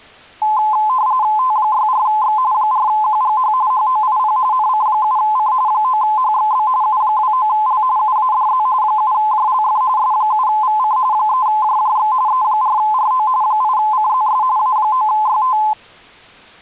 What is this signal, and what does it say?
RTTY (45.45 baud, 170 Hz shift), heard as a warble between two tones, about 940 Hz centre. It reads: T64X 4QGH HOIP NC7C 9HXB U29L UADZ 7JLF S7VC 3JJX E4RO 8CZS A9YT